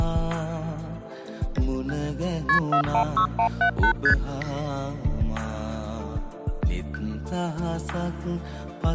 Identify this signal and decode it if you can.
Multi-frequency trunk signalling (R1, as on North American trunks), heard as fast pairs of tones, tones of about 90 ms. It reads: KP 416178 ST